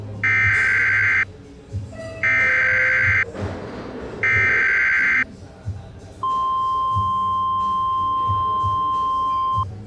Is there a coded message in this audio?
Yes: Emergency Alert System (SAME) tones (header bursts, then the 1050 Hz attention tone) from 0.2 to 9.6 s, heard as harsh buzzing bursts, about 520.83 baud, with the noise of a cafe.